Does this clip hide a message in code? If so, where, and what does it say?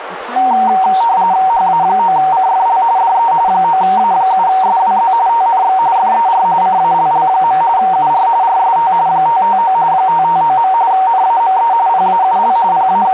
Yes: RTTY (45.45 baud, 170 Hz shift) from 0.4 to 13.1 s, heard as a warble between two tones, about 840 Hz centre, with radio static, a narrow filter and speech in English. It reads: HA9CFL DE 9A7SWZ TNX FER CALL. UR RST 559 559. NAME PAUL …